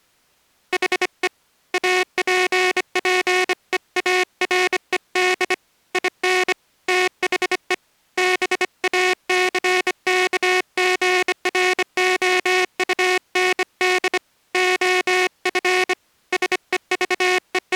Morse code, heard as a buzzer, hand-sent with a bug key, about 25 wpm. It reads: HE APPEARED IN THE BACKGROUND OF …